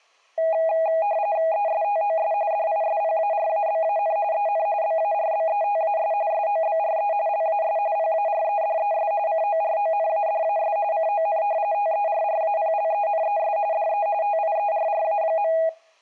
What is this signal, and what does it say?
RTTY (45.45 baud, 170 Hz shift), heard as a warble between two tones, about 730 Hz centre. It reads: ESTOS DISPARABAN EN BARBETAS SOBRE LAS PAREDES CORONADAS CON TERRAPLENES DE TIERRA.